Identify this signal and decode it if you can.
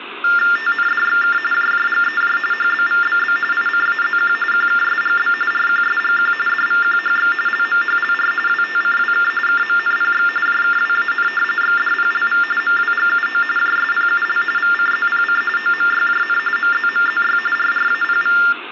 TTY/TDD text telephone tones (45.45 baud Baudot), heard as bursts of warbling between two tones, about 400 Hz shift, 1600 Hz centre, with phone line noise and room echo. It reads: TNDXK JJGEJ HBVBB ICAZQ QKSGB RQSGQ DVQHX LMHLR WTCWK KMNPX JKWAN XDPLV MWGUO JSPUL VCZPC OMYJN MZMZY RRAPV